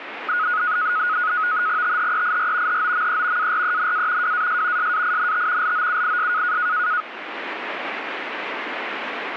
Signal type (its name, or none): NAVTEX (SITOR-B)